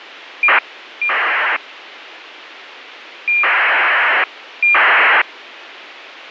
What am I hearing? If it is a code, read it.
ACARS aircraft data, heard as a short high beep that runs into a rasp, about 2400 baud, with radio hiss.